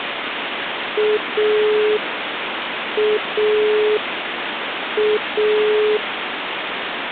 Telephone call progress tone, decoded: dial tone

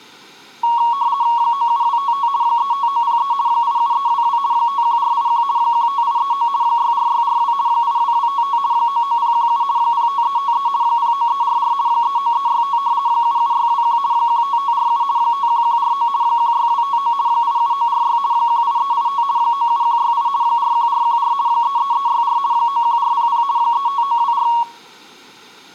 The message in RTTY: 97255 35903 87322 51481 15839 64642 82255 99017 05353 09344 39365 77621 15547 51149 16259 87946 18385 97168 41414 33364 91400 35924

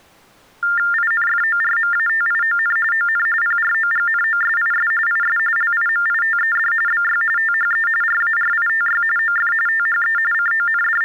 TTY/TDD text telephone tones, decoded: INFORMATION ON PROGNOSIS IS LIMITED BY THE RARITY OF THE …

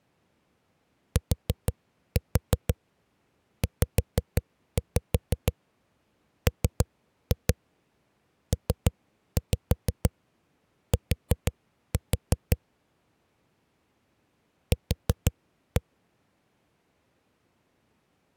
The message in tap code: TZMPT Q

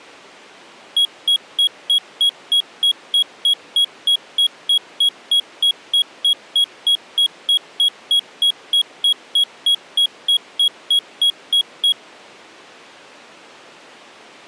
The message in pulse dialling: none

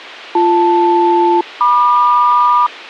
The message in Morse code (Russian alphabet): none

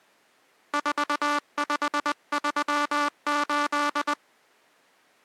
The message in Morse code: 4538

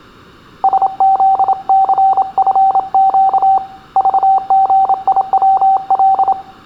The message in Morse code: SZCFQ VGIWL

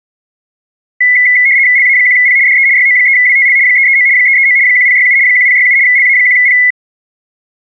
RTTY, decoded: LA1P DE YO3WTL 339 339 1067 1067 LA1P

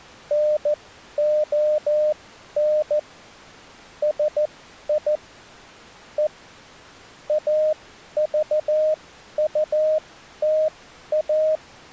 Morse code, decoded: NON SI E AVUTA

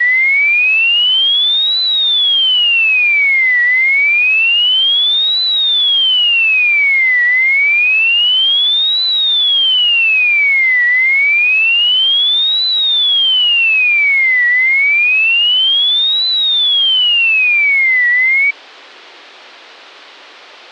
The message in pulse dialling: none

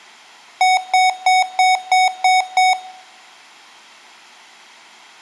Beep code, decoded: 7 short

